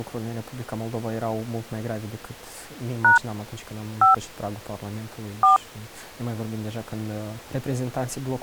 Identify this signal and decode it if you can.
DTMF, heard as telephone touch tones, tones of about 130 ms. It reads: # 5 4